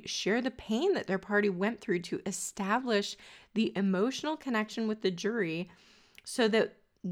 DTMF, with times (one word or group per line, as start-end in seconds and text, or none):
none